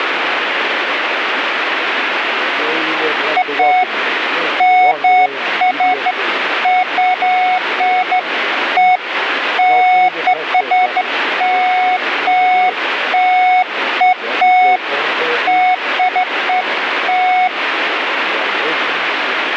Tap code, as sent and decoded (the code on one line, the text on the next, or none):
none